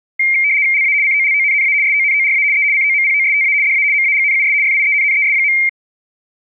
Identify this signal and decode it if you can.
RTTY (75 baud, 170 Hz shift), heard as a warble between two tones, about 2200 Hz centre. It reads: LA COLONNA SONORA E COMPOSTA DA MAGNUS FIENNES.